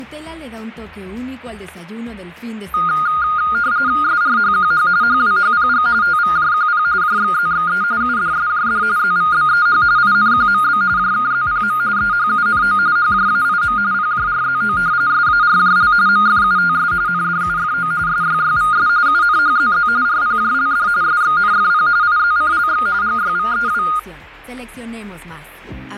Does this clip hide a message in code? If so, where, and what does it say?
Yes: RTTY (45.45 baud, 170 Hz shift) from 2.7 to 24.0 s, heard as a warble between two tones, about 1330 Hz centre, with static crashes. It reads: SRHQH HWHPG TVJQP JXZXE UDSJD ZVBEH INQMB JKZPM EHUNO HJAIM PJRZO SARJL MFUTS NDUFO SYYVS UNHZZ RPJLD SXNFP IZCLX GYVEW